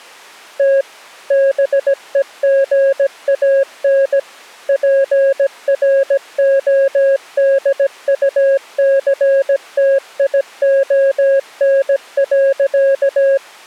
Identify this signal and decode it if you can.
Morse code, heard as a keyed tone, machine-sent, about 17 wpm, 550 Hz. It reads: T BEGAN PRODUCTION.